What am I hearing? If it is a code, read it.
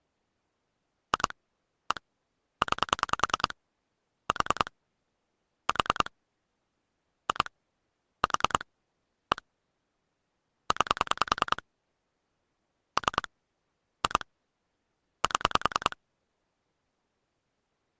Pulse dialling, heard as clicks on a phone line, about 10 pulses a second. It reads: 2 1 9 4 4 2 4 1 9 3 2 7